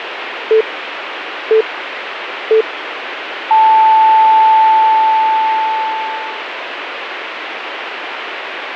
Radio time signal (three low pips and a long one an octave up, as on NHK), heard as pips, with radio static.